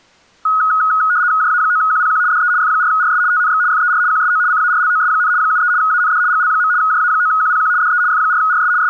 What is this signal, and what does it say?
RTTY (75 baud, 170 Hz shift), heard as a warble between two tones, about 1360 Hz centre. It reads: JA9QPQ DE F4RS TNX FER QSO CARLOS, 73 AND GL. JA9QPQ DE F4RS …